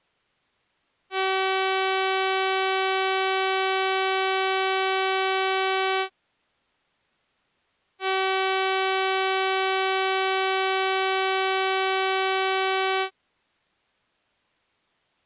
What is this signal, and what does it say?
Ship horn signal, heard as a ship's horn, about 380 Hz. 2 long. At sea: a vessel under power that has stopped in fog.